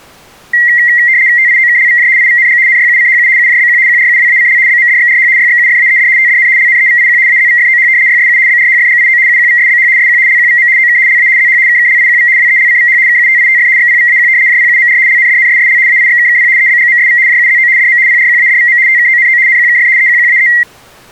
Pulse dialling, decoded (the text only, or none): none